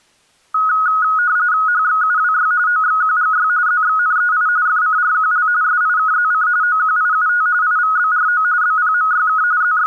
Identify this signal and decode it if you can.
RTTY (45.45 baud, 170 Hz shift), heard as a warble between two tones, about 1360 Hz centre. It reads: HXUWY OXQGY ZXNEI FCRQL SIKZC OQIUT IVBRO BPMYK …